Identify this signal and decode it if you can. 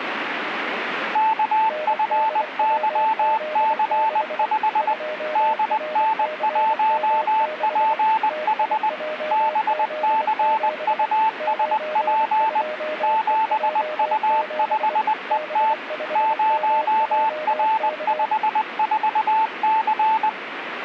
Morse code, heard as two keyed tones, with radio static. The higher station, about 20 wpm, 880 Hz: KFYC5 DN1PH BCUSP 7U5ET 0R54C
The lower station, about 24 wpm, 610 Hz: NDWZ6 2RCM6 TIJZ7 92EJ7 B5MJK